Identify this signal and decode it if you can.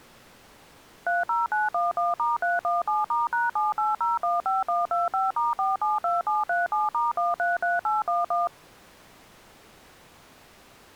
DTMF, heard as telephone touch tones, dialled by machine, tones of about 170 ms. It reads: 30911*317*#78015125*472737*133811